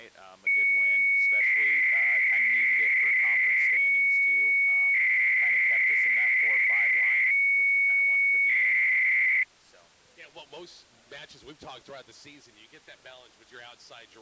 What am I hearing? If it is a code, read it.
300-baud modem data (Bell 103 tones), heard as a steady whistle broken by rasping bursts, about 300 baud, 200 Hz shift.